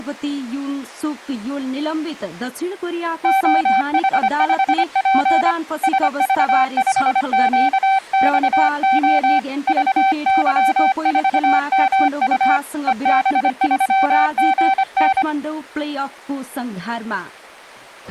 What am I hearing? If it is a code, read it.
Morse code, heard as a keyed tone, hand-sent with a paddle, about 25 wpm, 770 Hz. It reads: OH5P SV5QXO VY4MU EB3GN